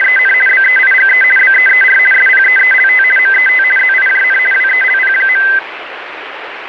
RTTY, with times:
0.0-0.3 …
0.5-1.2 BEIGE
1.4-2.0 BEER
2.1-3.0 SPEELT
3.2-3.6 MET
3.8-4.4 ZIJN
4.5-5.4 WELP.

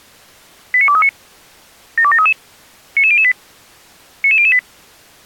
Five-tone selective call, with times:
0.7-1.1 89239
2.0-2.3 72733
3.0-3.3 99008
4.2-4.6 99008

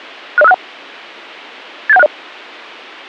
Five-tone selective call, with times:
0.4-0.5 60561
1.9-2.1 87160

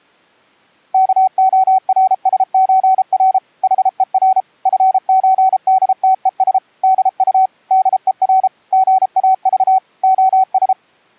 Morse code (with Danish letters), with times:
0.9-3.4 KORSØR
3.6-4.4 HER
4.7-6.6 FØDTES
6.8-7.5 DU
7.7-8.5 DER
8.7-9.8 GAV
10.0-10.7 OS

